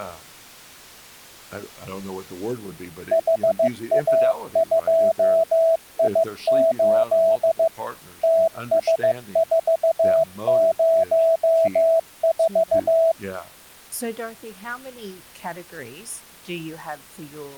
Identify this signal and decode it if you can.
Morse code, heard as a keyed tone, machine-sent, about 15 wpm, 660 Hz, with speech in English. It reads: HA2I8 TS404